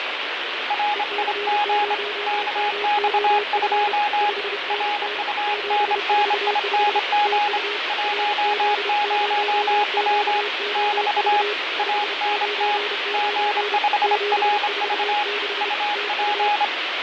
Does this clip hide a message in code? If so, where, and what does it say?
Yes: Morse code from 0.6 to 16.7 s, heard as two keyed tones, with radio static and fading. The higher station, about 26 wpm, 830 Hz: RIG KX2 RUNNING 10W <BT> ANT G5RV UP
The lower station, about 31 wpm, 420 Hz: EC0MOF 5NN 745 TU RZ0QOV 599 746 TU